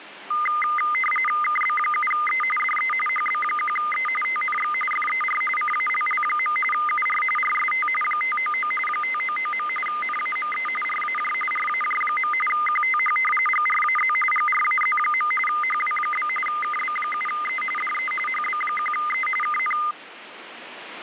RTTY (45.45 baud, 850 Hz shift), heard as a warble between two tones, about 1650 Hz centre, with radio static. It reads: KB7E DE HB1E TNX FER CALL. UR RST 599 599. NAME RAJ RAJ. QTH GRAZ GRAZ. HW? KB7E DE HB1E KN